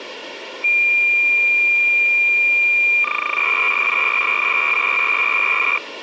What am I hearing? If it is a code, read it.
Cassette data (Kansas City type), 300 baud, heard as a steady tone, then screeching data, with tape hiss.